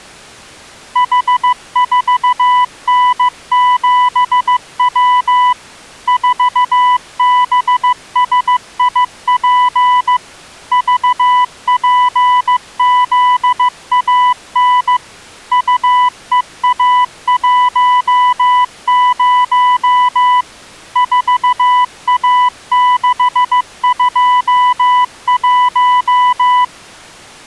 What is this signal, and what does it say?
Morse code, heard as a keyed tone, machine-sent, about 15 wpm, 990 Hz. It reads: H4N7W 4BSIP VPZAN UEA10 4A621